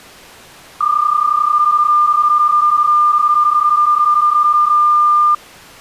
PSK31 (31.25 baud), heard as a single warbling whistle, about 1200 Hz.